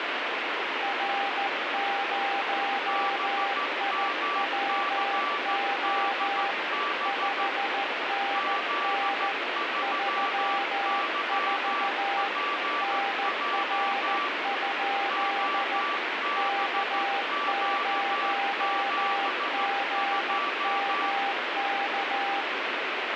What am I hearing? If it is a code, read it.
Morse code, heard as two keyed tones, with heavy radio static. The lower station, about 14 wpm, 800 Hz: R0IWO 5NN 34 NR? K0GMK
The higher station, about 14 wpm, 1160 Hz: BMCDB Z3YPJ OBQ72